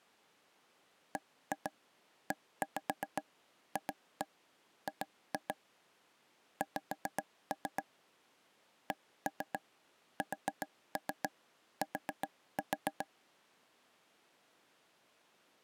Tap code, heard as taps on a table, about 7 knocks a second. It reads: BEFG X CST